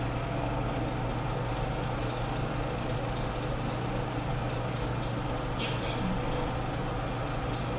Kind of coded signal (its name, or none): none